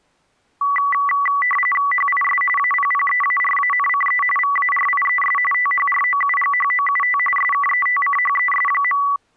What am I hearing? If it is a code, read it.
RTTY (45.45 baud, 850 Hz shift), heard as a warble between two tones, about 1550 Hz centre. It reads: HIS APPEARANCE VARIES THROUGHOUT SKETCHES.